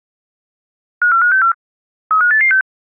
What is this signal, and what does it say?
Five-tone selective call (CCIR), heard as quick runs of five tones, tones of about 100 ms. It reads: 54564 35886